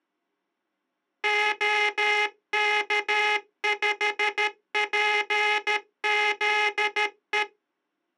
Morse code, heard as a buzzer, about 13 wpm. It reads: OK5PZE